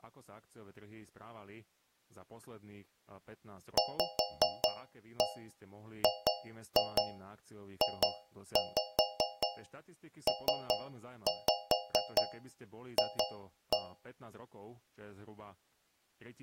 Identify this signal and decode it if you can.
Tap code, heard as taps on a metal pipe, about 5 knocks a second, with speech in Slovak. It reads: VGJPF